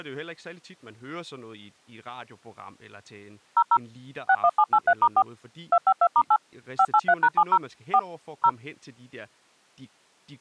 DTMF, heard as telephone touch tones, dialled by machine, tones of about 60 ms, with speech in Danish. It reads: 00 61783*4 252*8 583#70 4 0